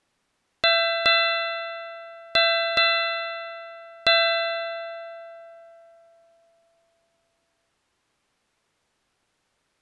Ship's bell, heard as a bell. 5. Five half-hours of the watch have passed.